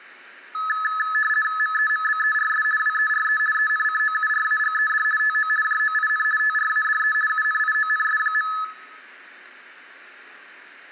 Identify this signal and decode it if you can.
RTTY (50 baud, 450 Hz shift), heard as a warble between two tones, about 1500 Hz centre, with room echo. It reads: MEMBERS WERE ENCOURAGED TO JOIN TRADE UNIONS.